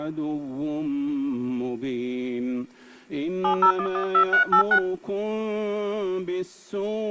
DTMF, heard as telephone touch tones, dialled by hand, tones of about 90 ms. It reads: 70112386